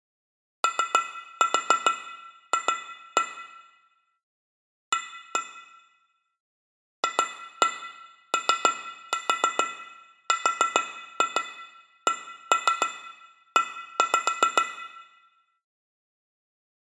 Tap code, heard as taps on glass, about 7 knocks a second, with room echo. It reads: OF A FORCE